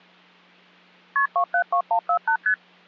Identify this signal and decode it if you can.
Multi-frequency trunk signalling (R1, as on North American trunks), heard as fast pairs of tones, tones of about 80 ms. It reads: KP 272148 ST